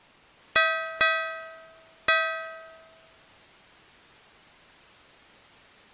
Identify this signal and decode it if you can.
Ship's bell, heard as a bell. 3. Three half-hours of the watch have passed.